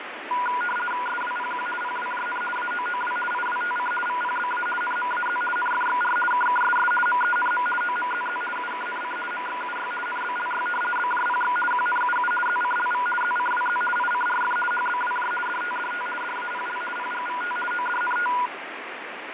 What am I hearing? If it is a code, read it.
RTTY (50 baud, 450 Hz shift), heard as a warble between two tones, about 1210 Hz centre, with radio static and fading. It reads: SWPQ PWJN AOOW IWTC VPBA NMAZ NFXR KKSS MENM OMZZ UKNC MXUY NBLY BJPX QNUU ZCLV ZCWZ ICRF HBWJ DTDT DAPL PGVT ODNT